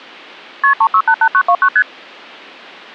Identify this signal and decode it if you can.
Multi-frequency trunk signalling (R1, as on North American trunks), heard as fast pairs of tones, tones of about 70 ms. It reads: KP 3688929 ST